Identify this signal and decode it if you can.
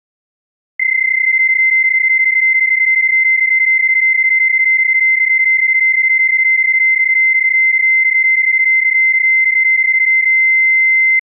PSK31 (31.25 baud), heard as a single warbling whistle, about 2050 Hz.